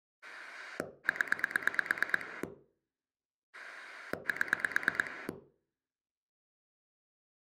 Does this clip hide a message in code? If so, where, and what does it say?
Yes: pulse dialling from 0.2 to 5.3 s, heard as a rotary dial, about 9 pulses a second, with room echo. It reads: 0 7